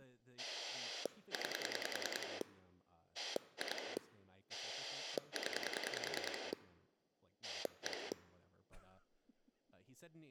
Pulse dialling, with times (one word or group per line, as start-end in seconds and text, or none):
0.4-2.4 9
3.1-4.0 2
4.5-6.5 0
7.4-8.1 1